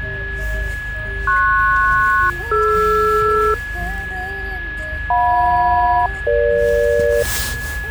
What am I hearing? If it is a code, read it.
Aircraft SELCAL, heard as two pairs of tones, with a steady whistle near 1690 Hz and the noise inside a car. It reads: PS-DR JM-EG